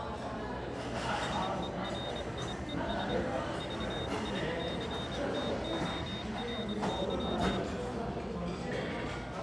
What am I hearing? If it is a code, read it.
Morse code, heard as a high beeper, hand-sent with a paddle, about 24 wpm, 3700 Hz, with the noise of a restaurant. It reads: SERIES VICTORY